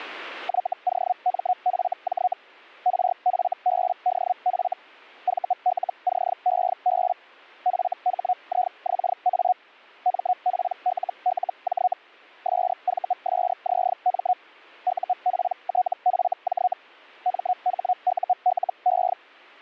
Hellschreiber (Feld-Hell, 122.5 baud), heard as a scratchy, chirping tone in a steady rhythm, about 730 Hz. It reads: YOMFJ RFBDF VLCEB FHIXA MPLLJ SVSZM UPTFJ MHULE